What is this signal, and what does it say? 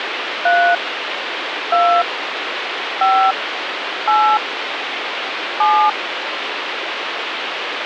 DTMF, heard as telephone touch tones, dialled by hand, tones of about 300 ms, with phone line noise. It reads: 3 2 5 8 7